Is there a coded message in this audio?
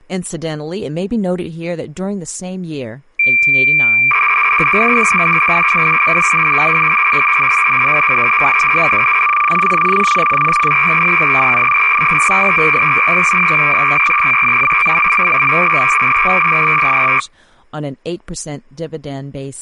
Yes: cassette data (Kansas City type), 300 baud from 3.2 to 17.2 s, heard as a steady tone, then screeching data, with speech in English.